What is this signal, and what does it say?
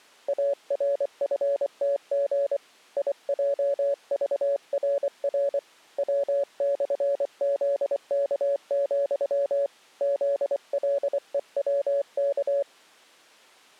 Morse code, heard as a keyed tone, hand-sent with a paddle, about 24 wpm, 560 Hz. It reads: ARFTG IJVRR W/ZK, ZLEWK